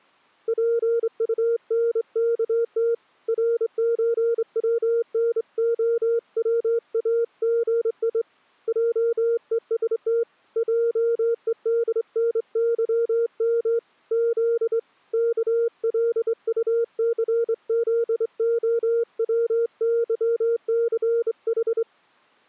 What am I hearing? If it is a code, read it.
Morse code (with Polish letters), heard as a keyed tone, hand-sent with a straight key, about 25 wpm, 470 Hz. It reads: PUNKT RÓWNOWAGI JEST JEDNYM Z KLUCZOWYCH